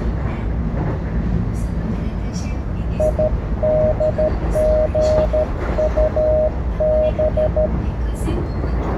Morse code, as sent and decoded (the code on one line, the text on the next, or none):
.. -.. --. ..- -...
IDGUB